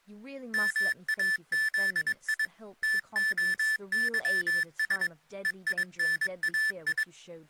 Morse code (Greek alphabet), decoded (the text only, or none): ΜΑΖΙ ΤΟΥΣ ΕΙΝΑΙ